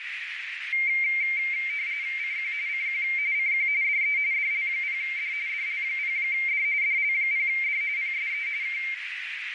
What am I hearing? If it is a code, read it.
RTTY (45.45 baud, 170 Hz shift), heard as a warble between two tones, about 2200 Hz centre, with radio static and a narrow filter. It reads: CQ CQ CQ DE DL0D DL0D DL0D PSE K